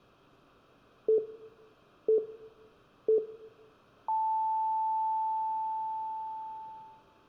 Radio time signal (three low pips and a long one an octave up, as on NHK), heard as pips, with room echo.